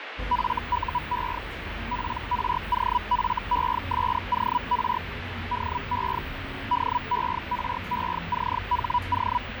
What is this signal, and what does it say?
Hellschreiber (Feld-Hell, 122.5 baud), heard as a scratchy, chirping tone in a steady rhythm, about 980 Hz, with radio static, fading and the noise inside a bus. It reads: FUE PROFESOR DE DERECHO